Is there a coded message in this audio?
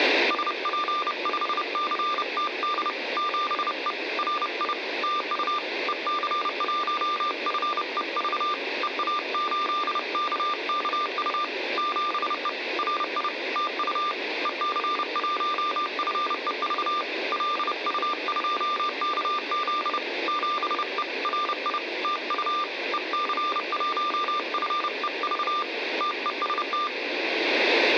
Yes: Morse code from 0.2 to 26.9 s, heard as a keyed tone, hand-sent with a bug key, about 30 wpm, 1190 Hz. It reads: SP5CTD 7E RI TU EC1FEV EA8KKU 7E RI TU EC1FEV LU2KZ 7E RI TU EC1FEV TEST